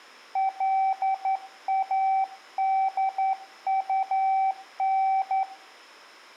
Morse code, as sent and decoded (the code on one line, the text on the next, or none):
.-.. .- -.. ..- -.
LADUN